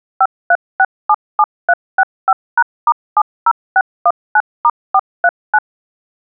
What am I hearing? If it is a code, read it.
DTMF, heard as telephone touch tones, dialled by machine, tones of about 50 ms. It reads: 53677365#*70619*439